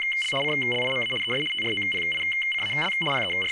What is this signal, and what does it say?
RTTY (75 baud, 850 Hz shift), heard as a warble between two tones, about 2550 Hz centre, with speech in English. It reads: … CLIMA ES TROPICAL …